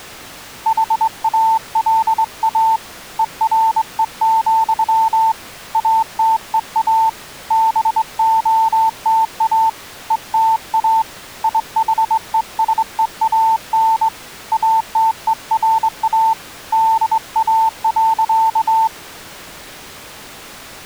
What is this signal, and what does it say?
Morse code, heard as a keyed tone, hand-sent with a straight key, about 22 wpm, 890 Hz. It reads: HALA ERE, ATEA BOTA ETA IHESEAN ATERA DA.